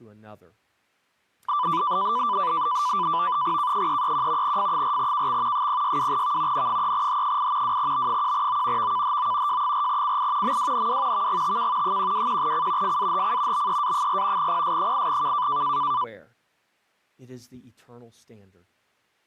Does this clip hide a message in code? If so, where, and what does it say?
Yes: NAVTEX (SITOR-B), 100 baud, 170 Hz shift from 1.5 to 16.0 s, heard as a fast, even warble, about 1080 Hz centre, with speech in English. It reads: K331 F4KX 062V N3H8 2B1O VKHO J4CI MWNW VGTK 121C FAHC BEA4 PS8K